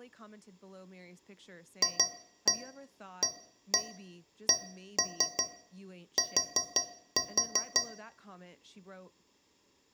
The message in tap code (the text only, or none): FACT